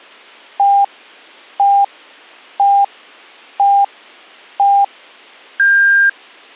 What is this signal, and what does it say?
Radio time signal (five pips and a higher one, as on Chinese radio), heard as pips, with a squelch burst at the end.